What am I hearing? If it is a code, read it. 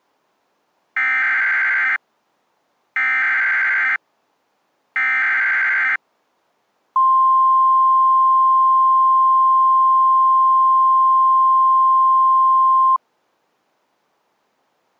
Emergency Alert System (SAME) tones (header bursts, then the 1050 Hz attention tone), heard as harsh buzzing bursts, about 520.83 baud.